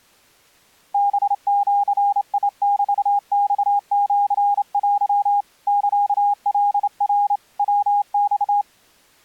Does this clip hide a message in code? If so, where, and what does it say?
Yes: Morse code (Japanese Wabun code) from 0.9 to 8.7 s, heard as a keyed tone, hand-sent with a straight key, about 28 wpm, 810 Hz. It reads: ハジメマシテ サカナ ヤマ